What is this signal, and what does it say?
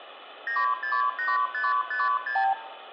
Multi-frequency trunk signalling (R2, with the far end's replies), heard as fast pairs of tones, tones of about 180 ms, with phone line noise and room echo. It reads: 968556